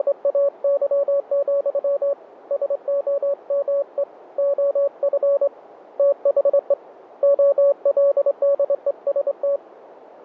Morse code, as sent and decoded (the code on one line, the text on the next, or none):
… / ... --- -- . / --- ..-. / - .... . / --- .-.. -.. . ... -
… SOME OF THE OLDEST